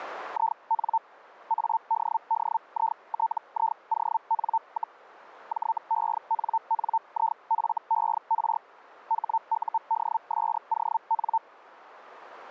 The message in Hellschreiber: IN ADDITION, JENNIFER HUDSON

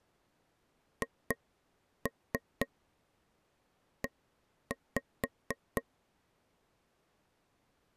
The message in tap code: HE

